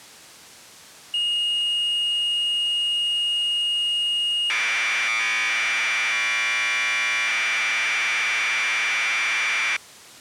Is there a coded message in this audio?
Yes: Commodore tape loading (standard loader) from 1.1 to 9.8 s, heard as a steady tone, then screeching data.